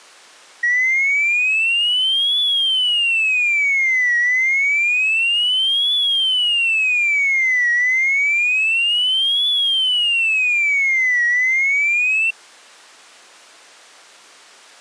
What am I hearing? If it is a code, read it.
A tone that sweeps in pitch again and again. There is no code.